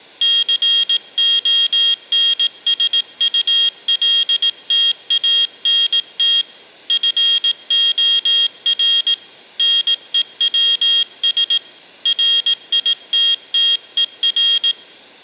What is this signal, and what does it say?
Morse code, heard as a high beeper, hand-sent with a paddle, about 18 wpm, 3250 Hz, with room echo. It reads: CONSULTANT FOR NEWS RITTER